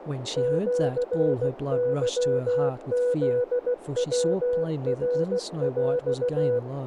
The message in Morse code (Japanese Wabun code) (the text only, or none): シケフヤナヰ